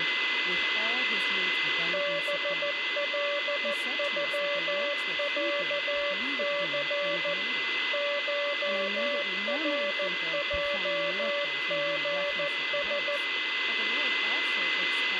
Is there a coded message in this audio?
Yes: Morse code (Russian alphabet) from 1.9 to 13.2 s, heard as a keyed tone, machine-sent, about 14 wpm, 580 Hz, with radio static, a steady whistle near 2030 Hz, room echo and speech in English. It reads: БЛЮЯЦ ШРЙГС